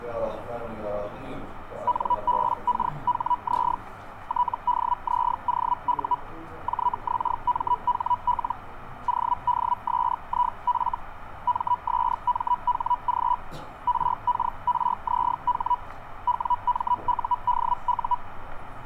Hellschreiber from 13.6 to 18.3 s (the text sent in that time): RKRZH WMUDU